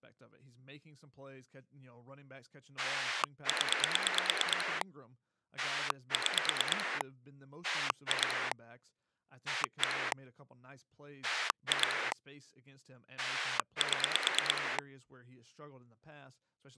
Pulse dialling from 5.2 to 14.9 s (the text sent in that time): 6 2 1 2 7